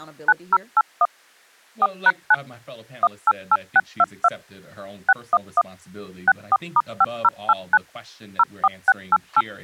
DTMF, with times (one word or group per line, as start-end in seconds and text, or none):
0.3-1.1 9081
1.8-2.3 4#9
3.0-4.3 188622
5.1-5.6 611
6.3-7.8 64*5089
8.4-9.4 04688